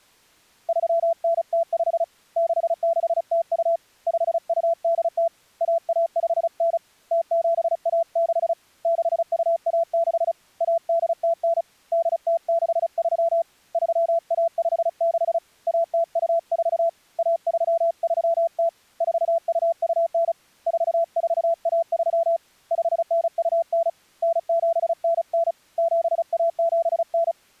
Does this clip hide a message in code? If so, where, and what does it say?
Yes: Morse code (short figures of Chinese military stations) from 0.6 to 27.4 s, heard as a keyed tone, hand-sent with a paddle, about 35 wpm, 670 Hz. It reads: 3905 6602 5280 1159 0716 6216 1809 8063 3156 1024 1330 4229 4413 5929 9799 7179